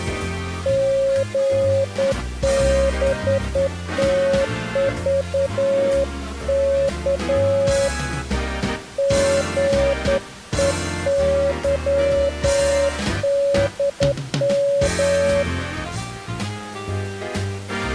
Morse code, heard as a keyed tone, hand-sent with a straight key, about 10 wpm, 550 Hz. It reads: GBTVK GEYDM